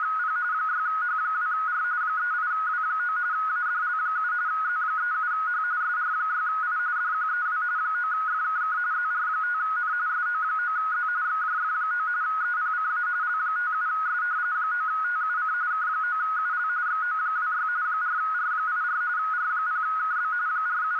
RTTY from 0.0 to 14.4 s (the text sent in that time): … 6H2R 38W9 ADL7 Z37H SR6I DQEW 9FKK ZR5N SO9Z XJF9 EPCA L57S